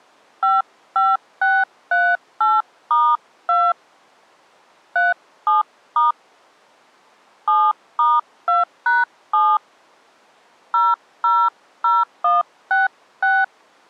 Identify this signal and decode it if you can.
DTMF, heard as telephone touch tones, dialled by hand, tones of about 200 ms. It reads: 55638*2 37* 7*2#7 000166